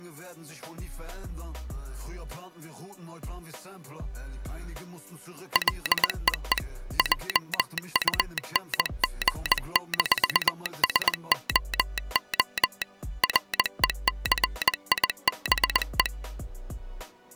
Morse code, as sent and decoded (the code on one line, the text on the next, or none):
.-.. . . / .--- ..- -. --. -....- ... --- --- / .-. . -.-. .. -... .
LEE JUNG-SOO RECIBE